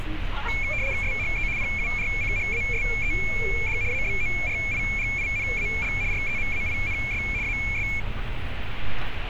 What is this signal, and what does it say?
RTTY (75 baud, 170 Hz shift), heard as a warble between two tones, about 2300 Hz centre, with radio static and street noise. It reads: SHE PURCHASED ABORIGINAL REMAINS AS